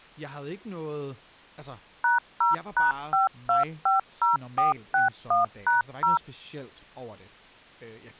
DTMF, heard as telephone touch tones, dialled by machine, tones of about 140 ms, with speech in Danish. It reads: #0#5250461#0